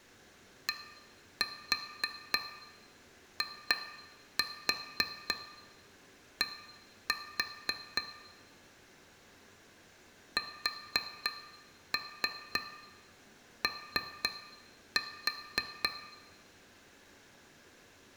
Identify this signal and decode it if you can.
Tap code, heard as taps on glass, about 3 knocks a second, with room echo. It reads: DID SO